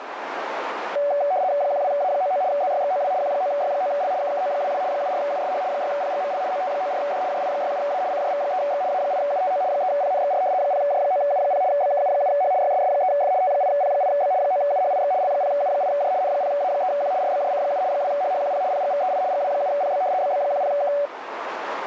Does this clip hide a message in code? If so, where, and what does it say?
Yes: RTTY (75 baud, 170 Hz shift) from 1.0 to 21.1 s, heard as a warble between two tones, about 660 Hz centre, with radio static and a narrow filter. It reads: 12A99 ZYXOW Q9Y9L KKO22 74USH 6PGML OT94D JI67A CJV3X A8UTO 3PNXR 0J9U0 BKU7H YSS3F T8P8B 9UHIX L0U8J N0A3Q RBJC7 2HHQP PGVEI GW7PB BB10K